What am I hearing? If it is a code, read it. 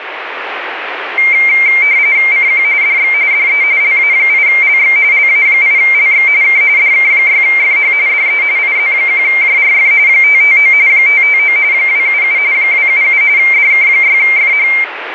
RTTY (45.45 baud, 170 Hz shift), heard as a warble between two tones, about 2200 Hz centre, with radio static. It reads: CQ DX DE LA8LX LA8LX K DK6FH DE IZ1JRF 559 559 277 277 DK6FH